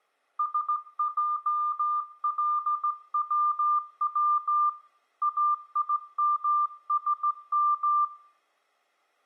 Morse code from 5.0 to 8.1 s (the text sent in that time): AIMSM